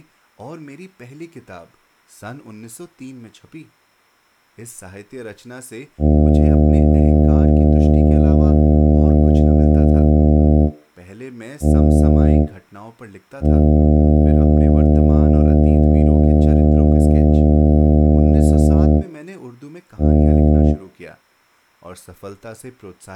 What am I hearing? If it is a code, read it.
Ship horn signal, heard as a ship's horn, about 80 Hz, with speech in Hindi. 1 long, 1 short, 1 long, 1 short. At sea: I agree to be overtaken.